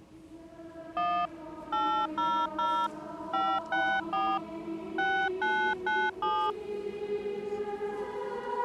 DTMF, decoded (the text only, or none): 1 800 564 6997